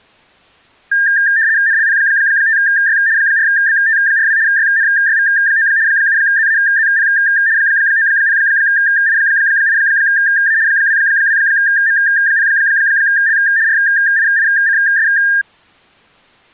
RTTY (75 baud, 170 Hz shift), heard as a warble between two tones, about 1700 Hz centre. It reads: NLP5Y 4BT42 YNYV9 7ZAZP 90I8A 22M0L RIICS